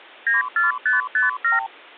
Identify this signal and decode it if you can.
Multi-frequency trunk signalling (R2, with the far end's replies), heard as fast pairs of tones, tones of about 150 ms. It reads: 94557